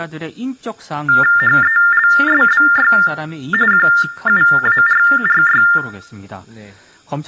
TTY/TDD text telephone tones (45.45 baud Baudot), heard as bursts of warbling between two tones, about 400 Hz shift, 1600 Hz centre, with room echo and speech in Korean. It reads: HELSBY QUARRY